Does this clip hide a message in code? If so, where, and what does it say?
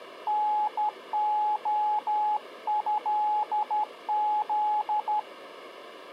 Yes: Morse code (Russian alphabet) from 0.2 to 5.3 s, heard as a keyed tone, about 12 wpm, 840 Hz. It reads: НОЭЗ